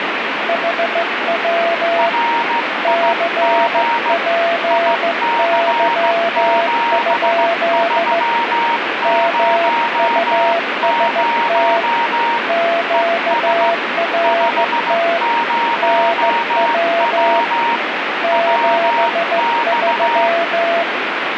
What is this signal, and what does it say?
Morse code, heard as two keyed tones, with radio static. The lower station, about 15 wpm, 680 Hz: HW CPY? MUST QRT NW 73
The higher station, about 15 wpm, 940 Hz: RIG IC7300 ES 50W WX